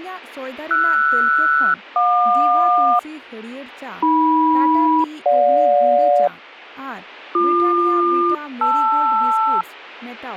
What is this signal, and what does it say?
Aircraft SELCAL, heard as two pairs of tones, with speech in Santali. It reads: RS-JQ AM-GJ BQ-LR